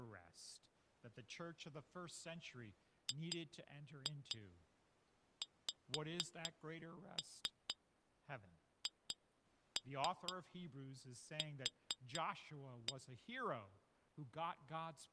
Tap code, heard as taps on glass, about 4 knocks a second, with speech in English. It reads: GXHQ